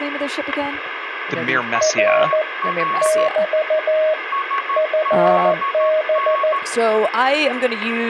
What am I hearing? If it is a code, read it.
Morse code, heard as a keyed tone, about 14 wpm, 620 Hz, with static crashes, a weaker station near 1110 Hz, room echo and speech in English. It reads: R <BT> FB